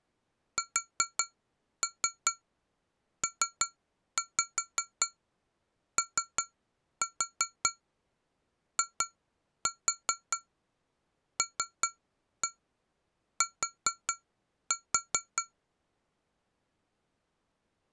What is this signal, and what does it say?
Tap code, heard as taps on glass, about 5 knocks a second. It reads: SPOILT